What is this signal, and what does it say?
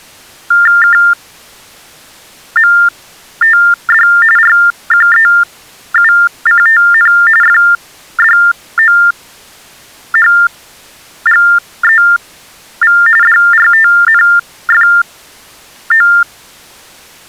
TTY/TDD text telephone tones (45.45 baud Baudot), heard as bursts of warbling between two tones, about 400 Hz shift, 1600 Hz centre. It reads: KMTD RQEUCTN FDOHGEV DRTNFO